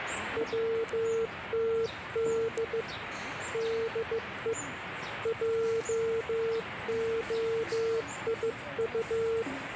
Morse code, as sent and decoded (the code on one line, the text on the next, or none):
.-- - -.. / -.. . / .--- --- .. ..-
WTD DE JOIU